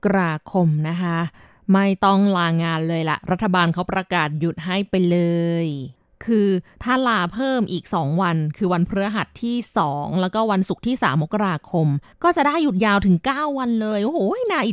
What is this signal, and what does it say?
Speech in Thai. There is no code.